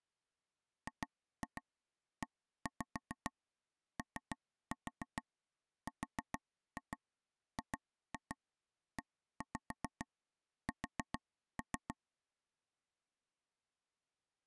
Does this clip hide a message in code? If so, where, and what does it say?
Yes: tap code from 0.9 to 11.9 s, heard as taps on a table, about 7 knocks a second. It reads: GEORGES